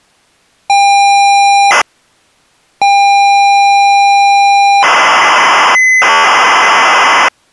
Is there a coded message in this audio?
Yes: ZX Spectrum tape loading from 0.7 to 7.3 s, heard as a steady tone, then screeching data.